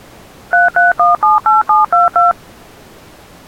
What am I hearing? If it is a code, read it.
DTMF, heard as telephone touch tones, dialled by machine, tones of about 160 ms. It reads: 33178722